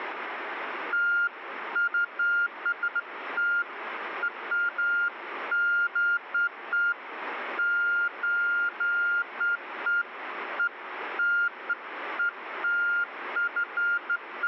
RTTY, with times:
none

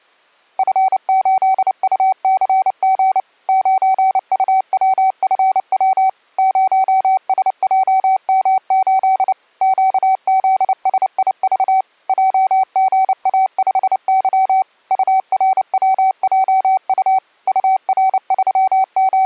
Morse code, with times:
0.6-3.2 F8UCG
3.5-6.1 9UWFW
6.4-9.3 0SJM8
9.6-11.8 QZSIV
12.1-14.6 JGA5Y
14.9-17.2 URWJU
17.5-19.3 …

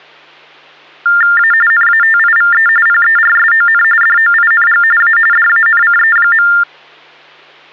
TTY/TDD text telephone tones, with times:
1.4-1.5 A
1.7-2.7 NATIVE
2.9-3.8 PERSON
4.0-4.8 DOING
5.0-5.2 A
5.3-6.5 DANCE.

